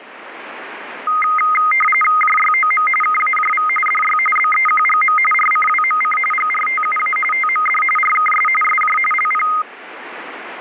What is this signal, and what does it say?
RTTY (45.45 baud, 850 Hz shift), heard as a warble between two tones, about 1650 Hz centre, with radio static. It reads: JYOM KAJV DY BEQGM RCWMC GRTUA TMD RKS SJ LP